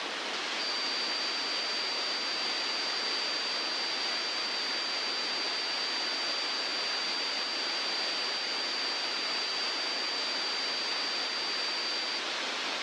A steady tone, with radio static. There is no code.